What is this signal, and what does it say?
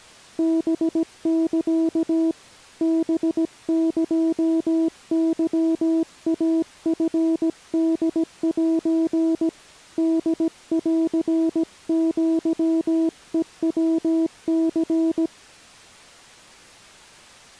Morse code (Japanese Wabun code), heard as a keyed tone, hand-sent with a paddle, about 17 wpm, 330 Hz. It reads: ハサ ハエケイチホセ ホンアヘヤニ